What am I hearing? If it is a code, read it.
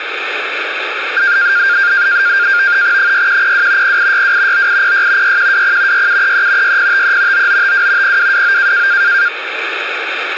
NAVTEX (SITOR-B), 100 baud, 170 Hz shift, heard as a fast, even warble, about 1500 Hz centre, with radio static. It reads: 6102 0862 9806 6120 6733 6053 9952 0229